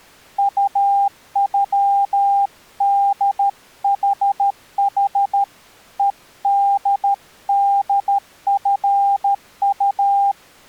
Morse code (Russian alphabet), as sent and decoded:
..- ..-- -.. .... .... / . -.. -.. ..-. ..-
УЮДХХ ЕДДФУ

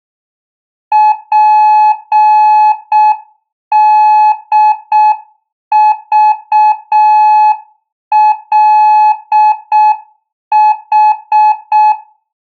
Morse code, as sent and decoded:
.--. -.. ...- .-.. ....
PDVLH

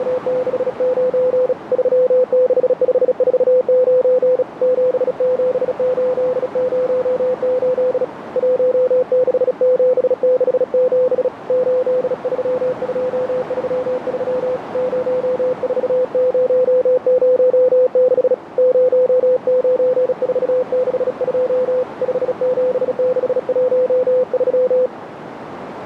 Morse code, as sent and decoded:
… / ...-- -.... ..... ....- ----. / --... --... ---.. ----- ---.. / .---- -.... --... -.... --... / ---.. ...-- ..--- ...-- ...-- / ----- ....- ----- ----- -.... / ----- ----. ....- -.... ..--- / ..... --... -.... .---- ...--
… 36549 77808 16767 83233 04006 09462 57613

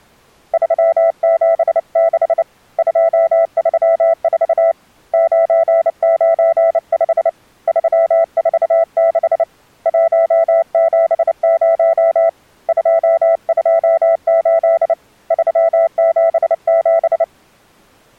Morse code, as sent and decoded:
...-- --... -.... / ..--- ...-- ....- / ----. ----. ..... / ...-- ....- -.... / .---- --... ----- / ..--- ..--- ---.. / ...-- --... --...
376 234 995 346 170 228 377

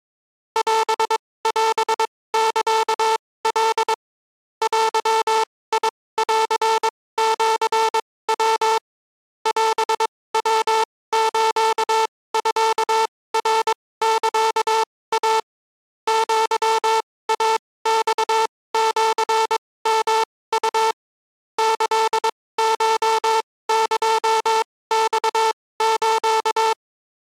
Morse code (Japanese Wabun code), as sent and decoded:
.-... .-... -.-.- .-.. / .-.-- .. .-.-. --.-. .-- / .-... .-- ---.- ..-.- .-. -.-.- .- / --.-- .- -..- --.-. -- ..- / -.-.. ---- -.--- -..- ---.-
オオサカ デンシヤ オヤスミナサイ アイマシヨウ キコエマス

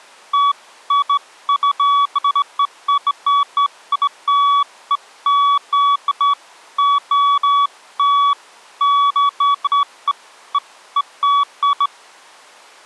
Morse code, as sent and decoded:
none

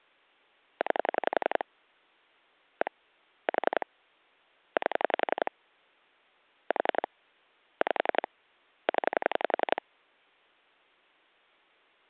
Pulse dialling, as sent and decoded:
9 / 1 / 4 / 8 / 4 / 5 / 10
9 1 4 8 4 5 0

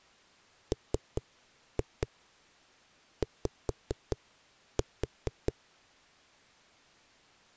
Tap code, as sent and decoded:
3-2 5-4
MY

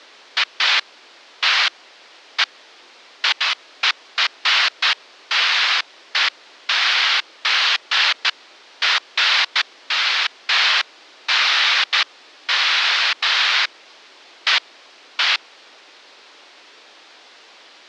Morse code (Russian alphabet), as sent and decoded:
none

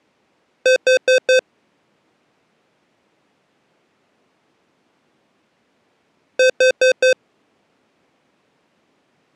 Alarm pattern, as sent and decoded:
4 beeps and a pause
temporal four

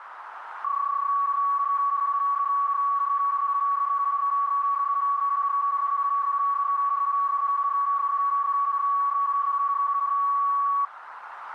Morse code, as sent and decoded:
none

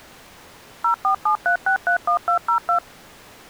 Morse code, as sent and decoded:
none

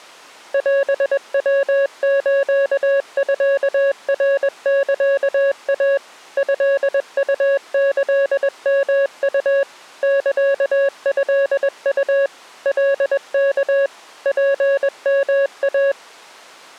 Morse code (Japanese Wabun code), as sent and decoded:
.-... .-- ---.- ..-.- .-. -.-.- .- / ..-.. ..- -.-.. -- ..- / -.-.- ..-.. ..- / .-.. -.- / .--. -- .-
オヤスミナサイ トウキヨウ サトウ カワ ツヨイ

